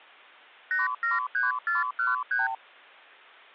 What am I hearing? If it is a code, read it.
Multi-frequency trunk signalling (R2, with the far end's replies), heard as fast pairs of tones, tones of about 160 ms. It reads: 873413